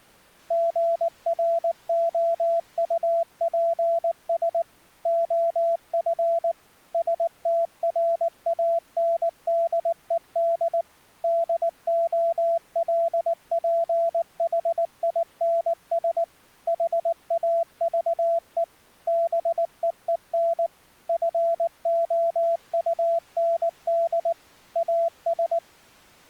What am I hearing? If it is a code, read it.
Morse code, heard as a keyed tone, machine-sent, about 19 wpm, 670 Hz. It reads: GROUPS OF STRANDED DOLPHINS HAVE BEEN FOUND AS